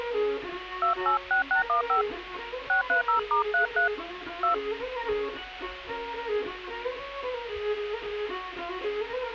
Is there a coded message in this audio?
Yes: DTMF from 0.8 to 4.5 s, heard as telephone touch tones, dialled by hand, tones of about 120 ms. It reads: 286615 630*33 2